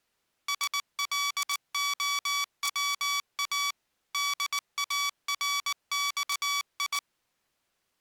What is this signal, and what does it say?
Morse code (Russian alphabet), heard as electronic beeps, machine-sent, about 19 wpm, 1140 Hz. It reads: СЛОВА ДАРЬИ